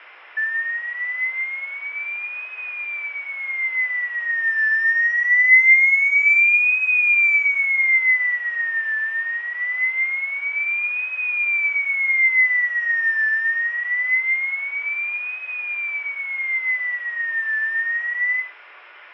A tone that sweeps in pitch again and again, with radio static, fading and room echo. There is no code.